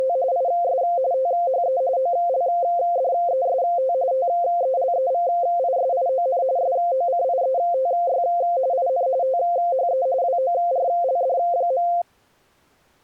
RTTY (45.45 baud, 170 Hz shift), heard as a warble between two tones, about 610 Hz centre. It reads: … IS THE OLDEST TELEVISION SOCIETY IN THE WORLD.